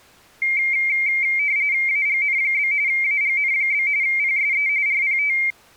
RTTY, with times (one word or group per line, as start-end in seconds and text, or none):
1.9-2.7 AGN?
2.9-3.9 AGN?
4.0-4.7 PSE
4.9-5.4 RPT